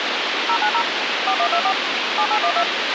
DTMF, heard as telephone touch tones, dialled by machine, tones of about 80 ms, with radio hiss and a squelch burst at the end. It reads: 090 4124 7812